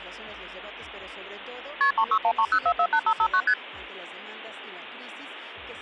Multi-frequency trunk signalling (R1, as on North American trunks), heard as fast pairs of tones, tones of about 70 ms. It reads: KP 36130448559 ST